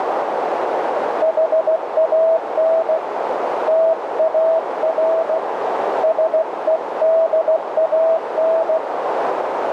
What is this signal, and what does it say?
Morse code, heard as a keyed tone, hand-sent with a paddle, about 16 wpm, 650 Hz, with heavy radio static and a narrow filter. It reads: HAN TAR SEDAN